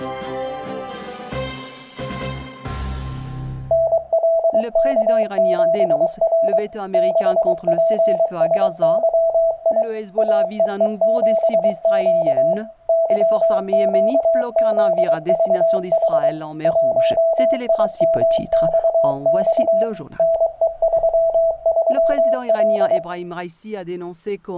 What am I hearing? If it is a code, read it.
Morse code, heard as a keyed tone, machine-sent, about 23 wpm, 660 Hz, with room echo. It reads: NLK7R 6PSYI AEE7Q YQZVH 1IMXX NE33L